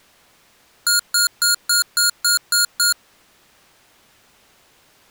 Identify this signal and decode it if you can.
Beep code, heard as beeps from a small speaker, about 1420 Hz. 8 short. In AMI BIOS tables: display memory failure; in Dell tables: LCD failure.